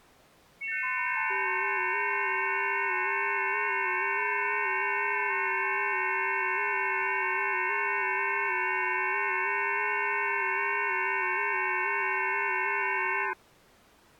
FT8 (several signals at once), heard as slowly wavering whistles, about 6.25 baud.